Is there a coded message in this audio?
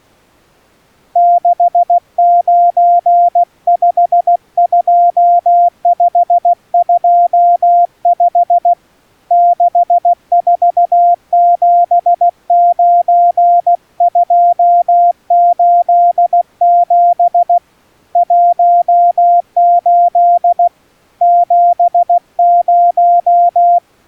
Yes: Morse code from 1.1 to 23.8 s, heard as a keyed tone, hand-sent with a paddle, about 16 wpm, 700 Hz. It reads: 6952525 6479287 18 70